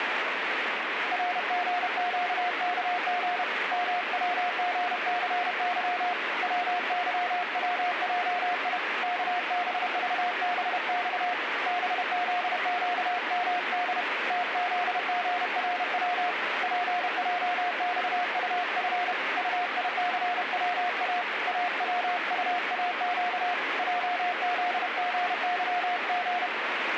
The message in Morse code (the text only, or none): RGQKG MWGCY WYWJI KBVBX BZQMD TZGRW PJXUF UICWA AWUAQ JZGYG